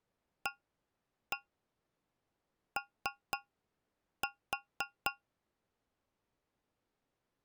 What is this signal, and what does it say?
Tap code, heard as taps on a metal pipe, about 3 knocks a second. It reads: AO